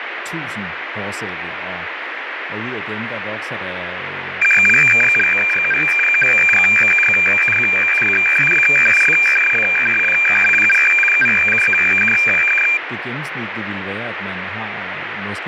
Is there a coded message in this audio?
Yes: weather fax (radiofax), 120 lines a minute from 4.4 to 12.8 s, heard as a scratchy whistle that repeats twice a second, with radio static and speech in Danish.